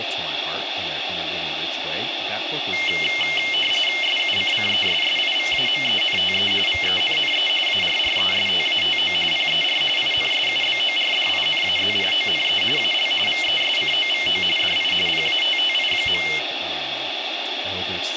RTTY (45.45 baud, 850 Hz shift), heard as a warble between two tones, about 2550 Hz centre, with radio static and speech in English. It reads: SUCCESSIVAMENTE VENNE ARRESTATO PER INSUBORDINAZIONE AL VESCOVO DI PATTI.